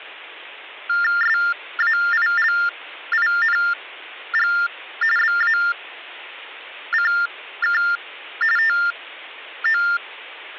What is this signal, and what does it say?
TTY/TDD text telephone tones (45.45 baud Baudot), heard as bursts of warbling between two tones, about 400 Hz shift, 1600 Hz centre. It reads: SAILING BACK TO